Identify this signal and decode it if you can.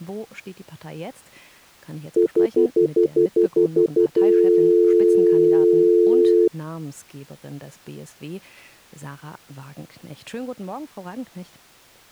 Telephone call progress tone (North American plan), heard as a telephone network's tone, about 350, 440 Hz, 0.1 s on and 0.1 s off. Stutter dial tone.